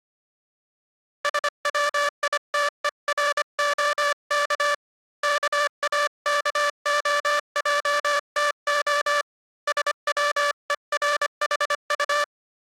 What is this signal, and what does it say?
Morse code (Russian alphabet), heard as a buzzer, hand-sent with a paddle, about 25 wpm. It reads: СВИТЕРОК КАКОЙТО СВЕРХУ